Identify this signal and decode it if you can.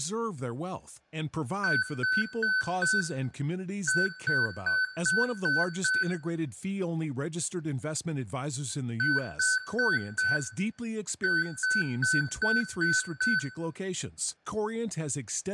Beep code, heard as beeps from a small speaker, played twice, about 1500 Hz, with room echo and speech in English. 4-6.